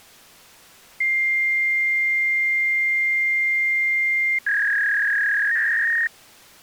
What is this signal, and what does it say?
Fax machine handshake, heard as a long tone and a warble.